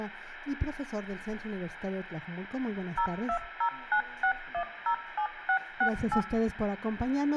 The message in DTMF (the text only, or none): 02096107668